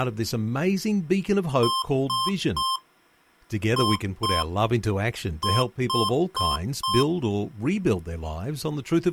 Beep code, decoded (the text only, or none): 3-2-4